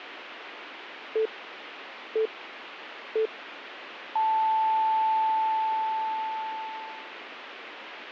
Radio time signal (three low pips and a long one an octave up, as on NHK), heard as pips, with radio static.